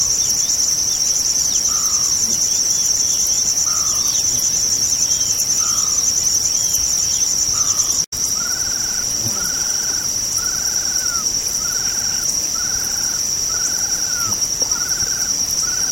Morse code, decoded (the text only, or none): none